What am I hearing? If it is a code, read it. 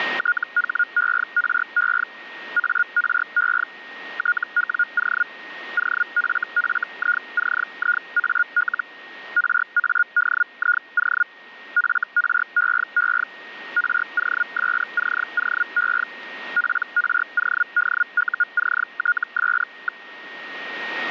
Hellschreiber (Feld-Hell, 122.5 baud), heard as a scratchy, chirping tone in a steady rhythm, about 1430 Hz, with a steady whistle near 1860 Hz. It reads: THERE ARE TWO OFFICIAL RADIO FREE ROSCOE PRODUCTS.